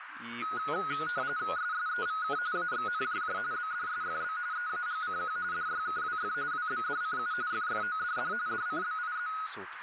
RTTY (45.45 baud, 170 Hz shift), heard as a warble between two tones, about 1360 Hz centre, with radio static, a narrow filter and speech in Bulgarian. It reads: SSEVK AXNJJ BDSFB EAGCQ DYKWF WBDCU FFODD DCBIZ